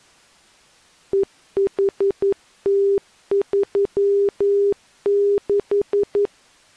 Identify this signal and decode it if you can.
Morse code, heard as a keyed tone, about 11 wpm, 400 Hz. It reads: EHT36